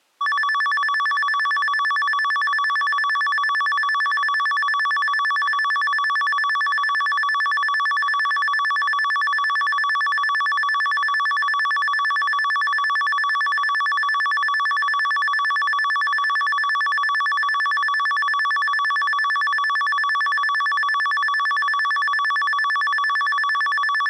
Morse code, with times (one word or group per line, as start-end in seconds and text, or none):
none